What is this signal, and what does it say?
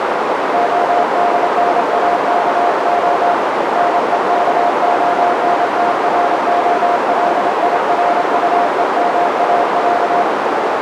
Morse code (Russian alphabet), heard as a keyed tone, hand-sent with a straight key, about 27 wpm, 700 Hz, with heavy radio static and a narrow filter. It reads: ОДНАКО НЕКОНТРОЛИРУЕМАЯ